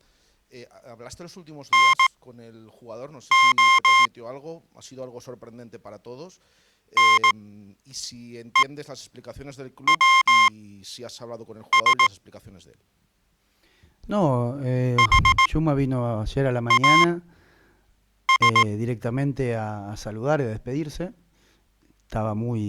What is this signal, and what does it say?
Morse code, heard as electronic beeps, machine-sent, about 18 wpm, spaced as for 6 wpm, 1060 Hz. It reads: NO NEWS HAS